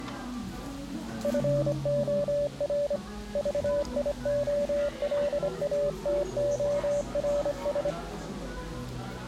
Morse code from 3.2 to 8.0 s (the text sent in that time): VIOLATORS